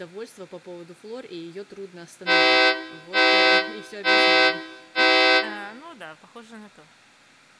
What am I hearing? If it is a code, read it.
Train horn signal, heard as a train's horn, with room echo and speech in Russian. 4 short. On North American railways: a request for a signal to be given or repeated.